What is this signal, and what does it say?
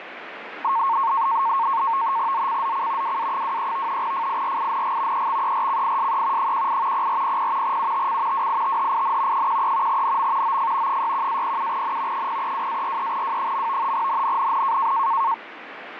NAVTEX (SITOR-B), 100 baud, 170 Hz shift, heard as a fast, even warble, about 1000 Hz centre, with radio static. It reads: ZCZC WA23 FIRING EXERCISE 18 0400 UTC WITHIN 13 NM OF 61-07N 032-43W. NNNN